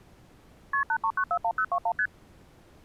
Multi-frequency trunk signalling (R1, as on North American trunks), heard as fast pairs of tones, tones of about 70 ms. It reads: KP 83941021 ST